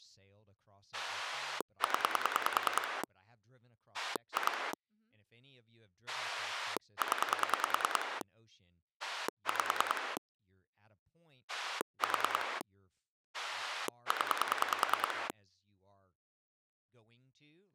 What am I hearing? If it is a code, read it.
Pulse dialling, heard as a rotary dial, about 10 pulses a second, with speech in English. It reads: 0 2 0 5 4 0